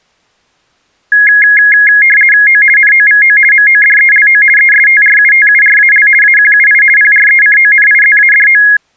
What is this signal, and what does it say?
RTTY (50 baud, 450 Hz shift), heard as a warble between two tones, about 1900 Hz centre. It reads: O NOVO MODELO ESTRUTURAL AQUI PRECONIZADO